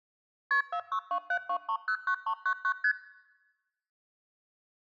Multi-frequency trunk signalling (R1, as on North American trunks), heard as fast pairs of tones, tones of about 80 ms. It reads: KP 46272309399 ST